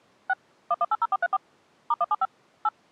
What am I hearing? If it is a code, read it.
DTMF, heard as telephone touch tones, dialled by machine, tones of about 40 ms. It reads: 6 1180434 *175 8